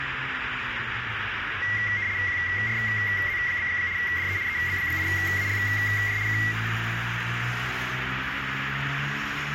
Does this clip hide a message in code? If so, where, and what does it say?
Yes: RTTY (75 baud, 170 Hz shift) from 1.6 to 6.5 s, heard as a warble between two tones, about 2050 Hz centre, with radio static and street noise. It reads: QRZ? DE EB8ALJ K